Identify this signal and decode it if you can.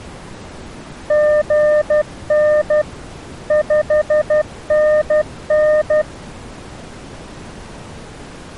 Morse code, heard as a keyed tone, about 12 wpm, 610 Hz. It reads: GN 5NN